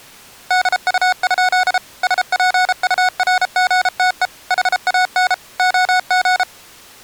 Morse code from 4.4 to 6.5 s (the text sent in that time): HAN OG